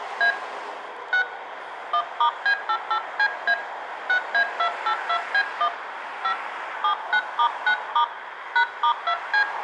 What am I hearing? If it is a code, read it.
DTMF, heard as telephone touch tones, dialled by hand, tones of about 80 ms, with room echo and street noise. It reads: A 6 1*B88CA 6A282B1 5 79*9* #*2C